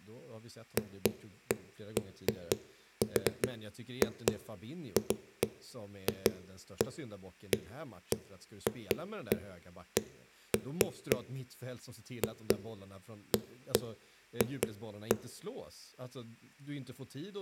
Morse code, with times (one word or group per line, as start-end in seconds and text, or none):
none